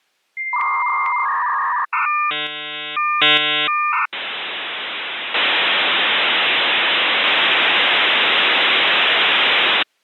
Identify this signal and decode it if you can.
Dial-up modem handshake (V.34 or later), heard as a whistle, warbles, then hiss.